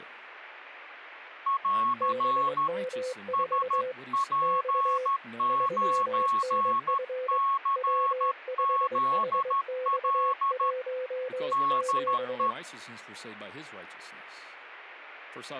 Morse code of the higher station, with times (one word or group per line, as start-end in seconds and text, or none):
1.5-2.7 <AR>
3.3-10.7 SP9CZL
11.5-12.5 DE